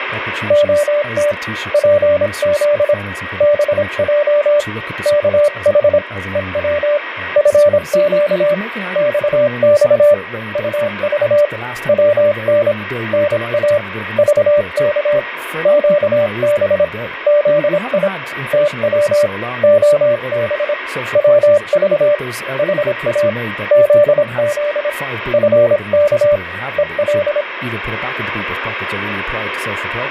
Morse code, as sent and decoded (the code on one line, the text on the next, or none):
--- - / .--. --.. / -... .--- / -.- .... / . .-- / ..-. --.- / -..- -..- / ..- ...- / .-- -. / -. .- / ...- -.- / --.- -... / --.. .. / - .-- / --- -... / .-- ...- / .... .- / --.. --.. / ..-. -.- / . .-..
OT PZ BJ KH EW FQ XX UV WN NA VK QB ZI TW OB WV HA ZZ FK EL